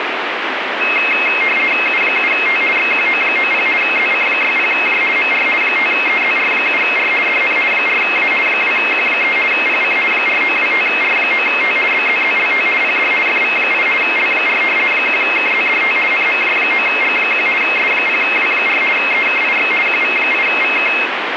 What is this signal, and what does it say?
RTTY (50 baud, 450 Hz shift), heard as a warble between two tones, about 2350 Hz centre, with radio static. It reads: U7T XQO90 ZC60J MR 5EZR7R DN 4A 2Q3 PC 4925R9T BZZLT PD FV8 L4 1KZDT NMJ9G1 S0W4 EKIX QV8VK